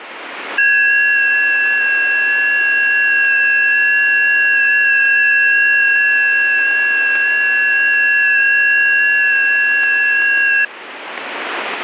FT8 (several signals at once), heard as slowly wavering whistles, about 6.25 baud, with radio static.